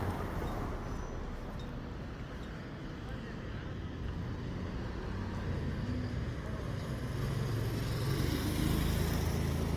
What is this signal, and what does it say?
The noise of a residential street. There is no code.